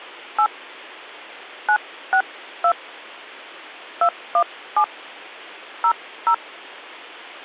DTMF, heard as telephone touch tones, dialled by hand, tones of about 80 ms. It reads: 8 962 217 00